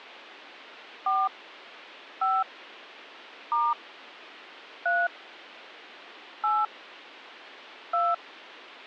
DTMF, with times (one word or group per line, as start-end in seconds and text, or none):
1.1-1.3 4
2.2-2.4 5
3.5-3.7 *
4.9-5.1 3
6.4-6.7 8
7.9-8.1 2